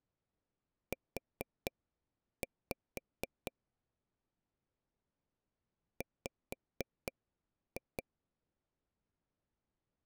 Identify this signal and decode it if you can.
Tap code, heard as taps on a table, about 4 knocks a second. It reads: U W